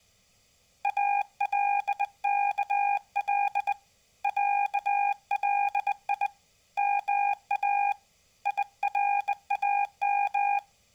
Morse code (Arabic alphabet), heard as a keyed tone, hand-sent with a bug key, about 20 wpm, 810 Hz. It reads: الكل علي ما يرام